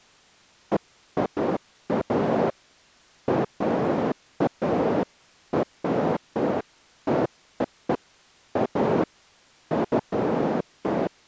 Bursts of noise. There is no code.